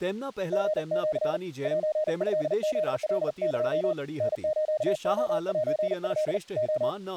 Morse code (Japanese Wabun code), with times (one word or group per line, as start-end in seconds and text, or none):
0.5-1.4 リシ
1.6-3.9 セトフカエ
4.2-6.4 タスレセト
6.6-6.9 レ